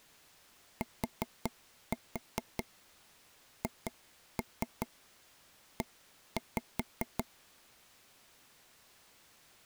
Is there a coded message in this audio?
Yes: tap code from 0.8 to 7.2 s, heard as taps on a table, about 5 knocks a second. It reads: THE